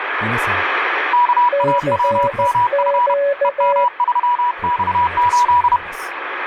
Morse code, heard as two keyed tones, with radio static. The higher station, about 31 wpm, 970 Hz: KAWMF EM3X8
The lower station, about 14 wpm, 560 Hz: CQ